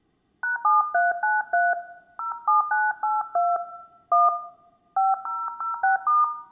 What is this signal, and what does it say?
DTMF, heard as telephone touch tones, dialled by hand, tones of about 180 ms, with room echo. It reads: #7393 07982 1 5006*